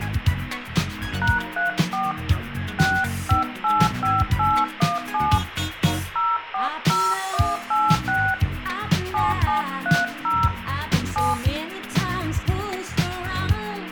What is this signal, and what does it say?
DTMF, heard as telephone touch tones, dialled by hand, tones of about 200 ms, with radio hiss and room echo. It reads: #34 6585817 040186 7730 7